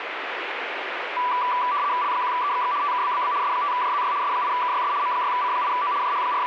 RTTY (75 baud, 170 Hz shift), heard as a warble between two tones, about 1080 Hz centre, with radio static. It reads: L1EXX TKBBB S5JZY S8KYS M6C8O …